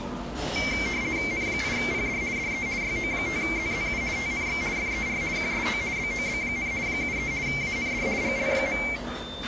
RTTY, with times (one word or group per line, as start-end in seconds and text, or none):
1.3-2.2 N8PD
2.4-2.7 DE
2.8-4.0 YO5ZZU
4.2-4.6 TNX
4.8-5.2 FER
5.4-5.8 QSO
6.0-6.7 BOB,
6.9-7.3 73
7.5-8.1 AND
8.2-8.8 GL.